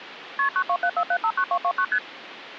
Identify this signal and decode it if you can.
Multi-frequency trunk signalling (R1, as on North American trunks), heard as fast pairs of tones, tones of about 70 ms, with phone line noise. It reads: KP 9274759229 ST